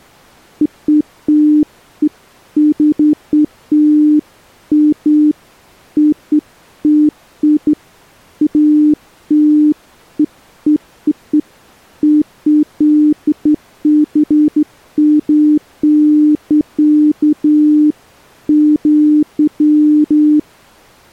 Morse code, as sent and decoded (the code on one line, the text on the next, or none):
none